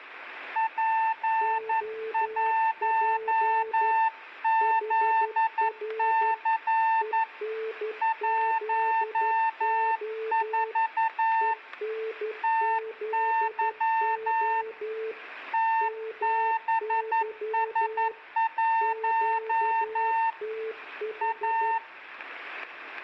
Morse code, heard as two keyed tones, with static crashes and room echo. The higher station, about 11 wpm, 900 Hz: P1ZC 14 TY TBS1 A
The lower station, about 12 wpm, 440 Hz: OP HR ENZO ENZO MY QTH